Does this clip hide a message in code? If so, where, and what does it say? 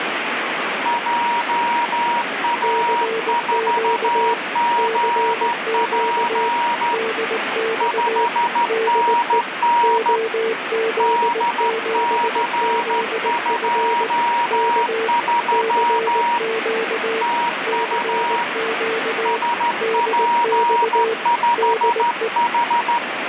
Yes: Morse code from 0.8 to 23.0 s, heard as two keyed tones, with radio static. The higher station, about 13 wpm, 950 Hz: JA4GP 5NN DC23 TU SP5H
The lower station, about 19 wpm, 450 Hz: CQ CQ DX DE OZ7ZF K CQ CQ DX DE